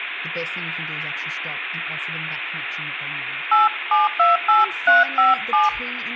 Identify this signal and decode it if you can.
DTMF, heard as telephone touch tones, dialled by hand, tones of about 160 ms, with phone line noise and speech in English. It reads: 8728357